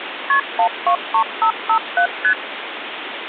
Multi-frequency trunk signalling (R1, as on North American trunks), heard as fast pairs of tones, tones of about 90 ms, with phone line noise. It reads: KP 123557 ST